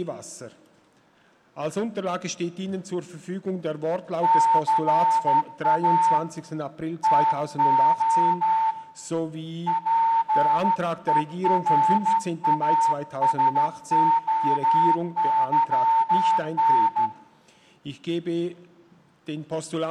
Morse code (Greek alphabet), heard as a whistle, hand-sent with a straight key, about 13 wpm, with room echo. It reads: ΘΑ ΤΟ ΠΕΡΑΣΟΥΝ